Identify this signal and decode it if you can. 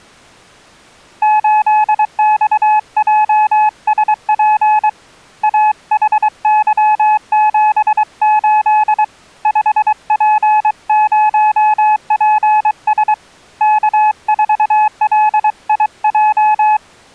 Morse code, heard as a keyed tone, hand-sent with a paddle, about 23 wpm, 850 Hz. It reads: 8XJSP AHY78 5P0PS K4LIJ